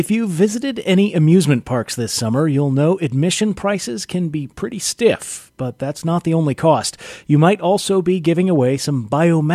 Speech in English. There is no code.